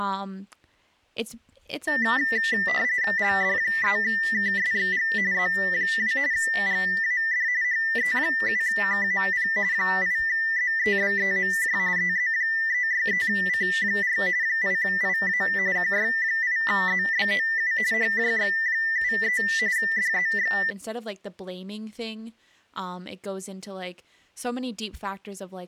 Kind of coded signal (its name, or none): RTTY